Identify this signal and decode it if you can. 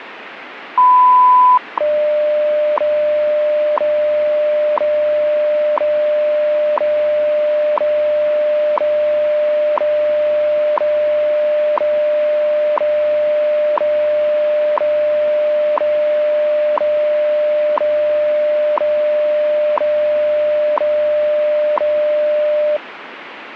Radio time signal (WWV, Colorado), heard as ticks, one a second, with radio static.